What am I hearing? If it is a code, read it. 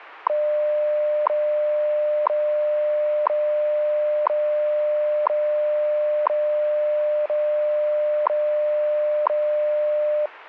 Radio time signal (WWV, Colorado), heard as ticks, one a second.